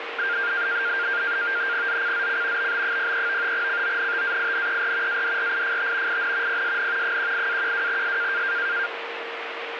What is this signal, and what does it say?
NAVTEX (SITOR-B), 100 baud, 170 Hz shift, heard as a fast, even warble, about 1500 Hz centre, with radio static and a steady whistle near 460 Hz. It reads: ZCZC BB03 CONTAINER ADRIFT IN PSN 18-12S